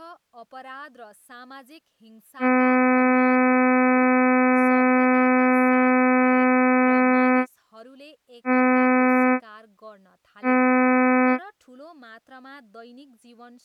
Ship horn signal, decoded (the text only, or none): 1 long, 2 short